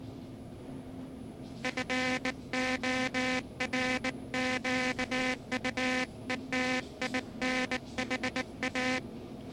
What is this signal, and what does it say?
Morse code, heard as a buzzer, hand-sent with a bug key, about 19 wpm, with the noise inside a lift. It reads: FORQUETINHA